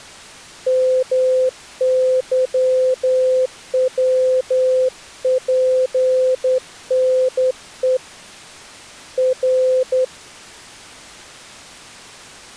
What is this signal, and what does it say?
Morse code, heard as a keyed tone, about 10 wpm, 510 Hz. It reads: MYWPNE R